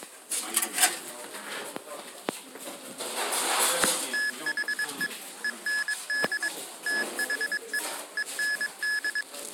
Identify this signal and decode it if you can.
Morse code, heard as electronic beeps, machine-sent, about 22 wpm, 1700 Hz, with kitchen noise. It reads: THE END THE END